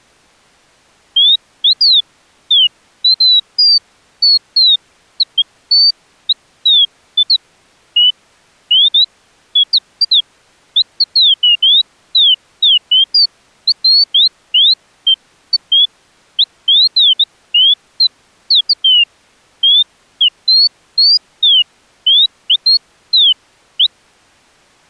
Bird-like chirps. There is no code.